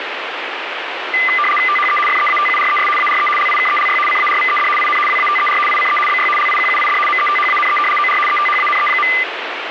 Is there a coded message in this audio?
Yes: RTTY (75 baud, 850 Hz shift) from 1.1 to 9.2 s, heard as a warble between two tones, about 1600 Hz centre, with radio static. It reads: THE FEATURES ARE LIKELY CARVED IN WATER ICE BY LIQUID METHANE OR ETHANE.